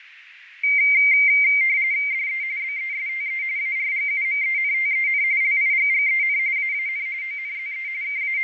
RTTY (45.45 baud, 170 Hz shift), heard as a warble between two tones, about 2200 Hz centre, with radio static, fading and a narrow filter. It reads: DE BESTE ARGUMENTEN LIGGEN AAN ONZE …